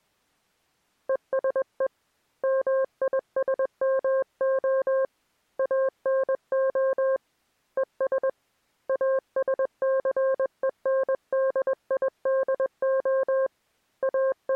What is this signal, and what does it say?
Morse code, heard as a keyed tone, hand-sent with a paddle, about 21 wpm, 530 Hz. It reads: ESE MISMO ANO ES ASCENDIDO …